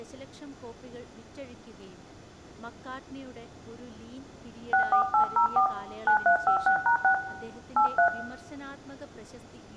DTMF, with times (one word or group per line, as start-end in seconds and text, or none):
4.7-5.7 64804
6.1-7.1 9356#6
7.8-8.1 83